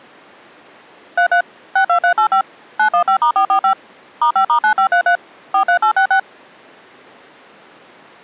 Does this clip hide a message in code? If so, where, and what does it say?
Yes: DTMF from 1.2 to 6.2 s, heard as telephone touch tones, dialled by machine, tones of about 90 ms. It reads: 33 62385 915*445 *5*9533 43866